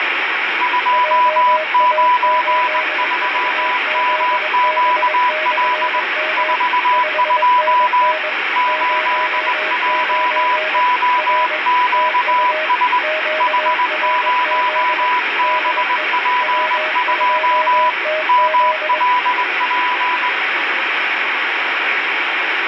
Morse code, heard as two keyed tones, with heavy radio static. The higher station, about 20 wpm, 990 Hz: 293MQL 42 8JOQS H0BP2 MLP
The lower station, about 22 wpm, 630 Hz: JA8VZB/M 5NN 09 R TU QRZ DE W2TZ